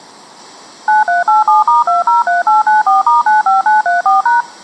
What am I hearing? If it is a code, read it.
DTMF, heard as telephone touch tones, dialled by machine, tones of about 150 ms. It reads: 9387*203894*95934#